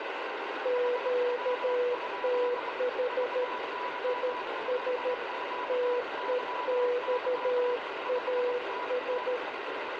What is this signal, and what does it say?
Morse code, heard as two keyed tones, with heavy radio static. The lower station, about 13 wpm, 490 Hz: QTH IS TEXAS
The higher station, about 23 wpm, 990 Hz: HW? VY4QYY 5NN